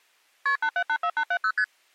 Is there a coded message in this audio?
Yes: multi-frequency trunk signalling (R1, as on North American trunks) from 0.5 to 1.6 s, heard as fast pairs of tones, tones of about 70 ms. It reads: KP 8784870 ST